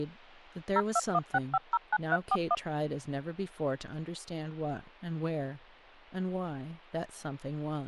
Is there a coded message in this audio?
Yes: DTMF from 0.8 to 2.5 s, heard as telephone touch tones, dialled by machine, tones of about 40 ms, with speech in English. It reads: 0216509341